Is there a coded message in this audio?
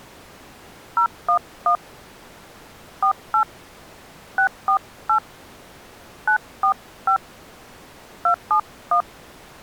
Yes: DTMF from 1.0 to 9.0 s, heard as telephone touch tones, dialled by hand, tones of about 90 ms. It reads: 011 48 648 945 271